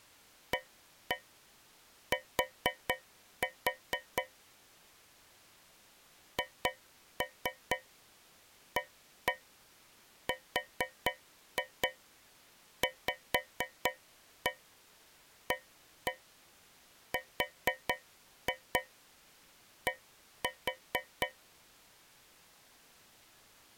Tap code, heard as taps on a metal pipe, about 4 knocks a second. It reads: AT HARVARD